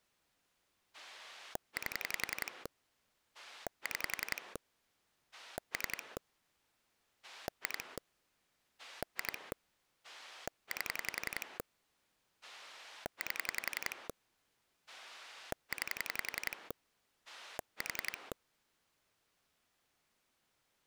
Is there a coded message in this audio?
Yes: pulse dialling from 0.9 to 18.3 s, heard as a rotary dial, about 11 pulses a second. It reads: 8 6 3 2 2 8 8 9 4